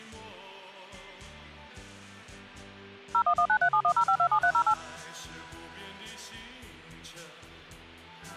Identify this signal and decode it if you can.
DTMF, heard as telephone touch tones, dialled by machine, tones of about 80 ms, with hum. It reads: 01193710527308